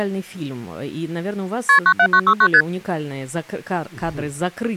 Multi-frequency trunk signalling (R1, as on North American trunks), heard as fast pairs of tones, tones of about 70 ms. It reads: KP 97969 ST